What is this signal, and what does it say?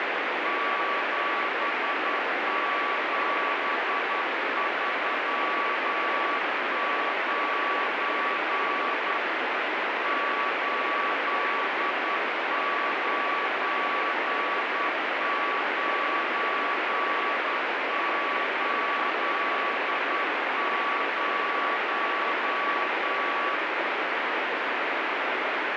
Morse code, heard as a keyed tone, hand-sent with a straight key, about 10 wpm, 1140 Hz, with heavy radio static. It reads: 7739 89980